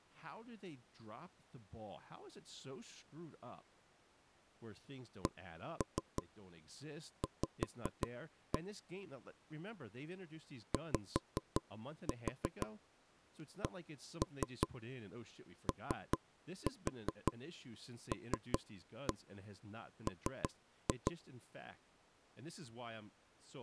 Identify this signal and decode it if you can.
Tap code, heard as knocks on wood, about 5 knocks a second, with speech in English. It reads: CV YCOLM